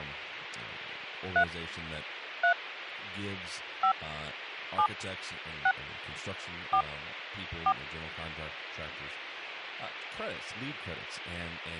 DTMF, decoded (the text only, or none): 3 3 5 7 6 4 4